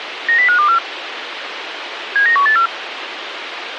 Five-tone selective call (CCIR), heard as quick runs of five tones, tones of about 100 ms, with radio hiss. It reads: 90524 79184